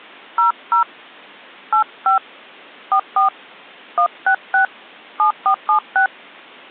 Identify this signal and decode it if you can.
DTMF, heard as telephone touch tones, dialled by hand, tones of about 100 ms. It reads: 00 85 44 166 7476